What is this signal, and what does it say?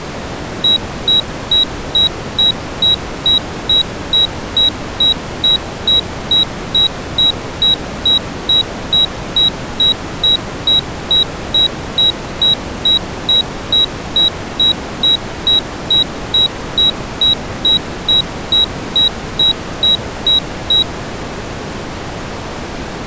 Evenly repeated beeps. There is no code.